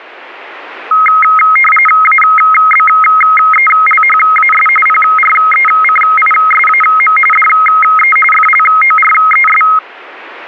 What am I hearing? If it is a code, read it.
RTTY (45.45 baud, 850 Hz shift), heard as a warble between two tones, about 1700 Hz centre, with radio static. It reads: ABELHAS PRECISAM DE FLORES